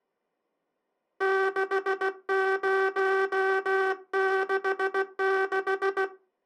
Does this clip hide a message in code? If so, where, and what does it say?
Yes: Morse code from 1.1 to 6.1 s, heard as a buzzer, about 16 wpm. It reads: 6066